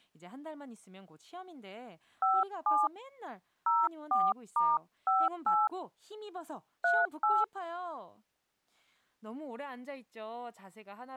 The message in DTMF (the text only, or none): 57 04*58 38